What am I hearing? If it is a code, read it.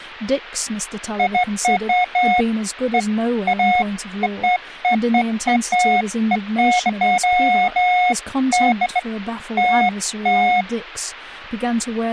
Beeps of irregular length, with speech in English. There is no code.